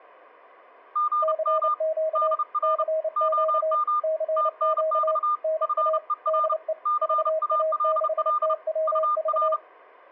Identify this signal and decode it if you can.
Morse code, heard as two keyed tones. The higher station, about 31 wpm, 1210 Hz: GM DR OM TNX FER CALL UR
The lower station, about 29 wpm, 630 Hz: CQ CQ CQ NA DE VA6TWV